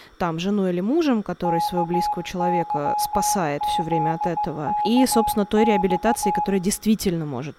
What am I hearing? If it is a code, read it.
Morse code, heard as a keyed tone, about 16 wpm, 840 Hz, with room echo and speech in Russian. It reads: KYZKX